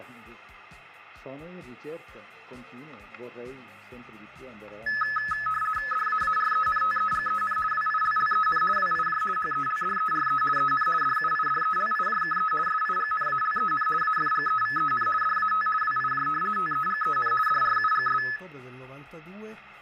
RTTY (50 baud, 450 Hz shift), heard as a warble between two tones, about 1500 Hz centre, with static crashes. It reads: DAARENTEGEN WILLEN WIJ HELDERE EN DUIDELIJKE SIGNALEN AFGEVEN DAT WIJ TEGEN DRUGS